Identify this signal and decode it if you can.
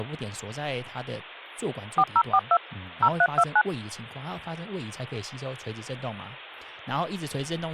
DTMF, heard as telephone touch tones, dialled by machine, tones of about 60 ms, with speech in Chinese. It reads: 4042 0329